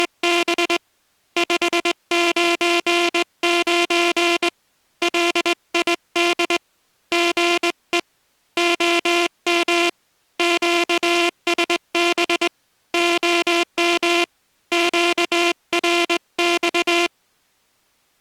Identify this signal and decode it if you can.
Morse code, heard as a buzzer, hand-sent with a straight key, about 20 wpm. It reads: … 599 LID GE OM QSB OM QRX